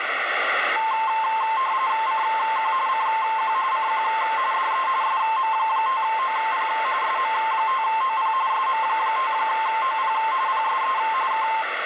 RTTY (45.45 baud, 170 Hz shift), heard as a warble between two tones, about 970 Hz centre, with radio static. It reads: CQ CQ CQ DE SM5OP SM5OP SM5OP PSE K